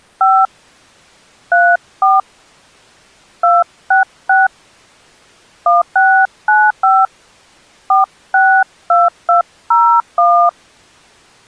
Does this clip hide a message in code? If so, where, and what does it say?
Yes: DTMF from 0.2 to 10.5 s, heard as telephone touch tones, dialled by hand, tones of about 220 ms. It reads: 5 34 266 1695 462201